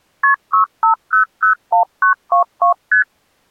Multi-frequency trunk signalling (R1, as on North American trunks), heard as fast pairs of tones, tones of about 110 ms. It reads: KP 65001922 ST